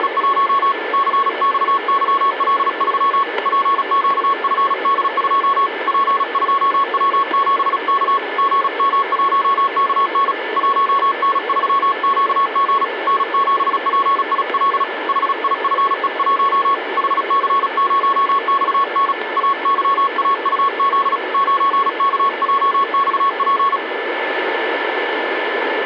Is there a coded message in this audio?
Yes: Morse code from 0.0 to 23.8 s, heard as a keyed tone, hand-sent with a paddle, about 36 wpm, 1100 Hz, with radio static and a steady whistle near 1750 Hz. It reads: … CXYL3 PQFD2 P2W7K GM1KN 1N3QG N7PIL HIFE1 HC0XN AYAUZ 9KJXP